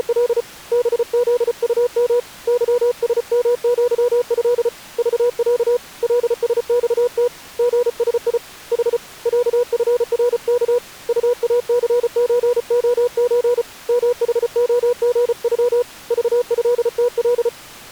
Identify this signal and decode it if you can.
Morse code (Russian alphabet), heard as a keyed tone, hand-sent with a paddle, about 34 wpm, 490 Hz. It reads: … БЗУМ ЫСМЪЭ ЖЯ ЛСЬТ ГСИ Х ЯФРК УАЦЧОЧ МХОГЮ ЖЭТЛ